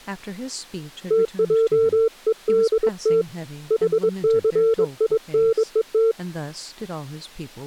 Morse code (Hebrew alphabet), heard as a keyed tone, hand-sent with a bug key, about 22 wpm, 450 Hz, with speech in English. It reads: תעודת חסינות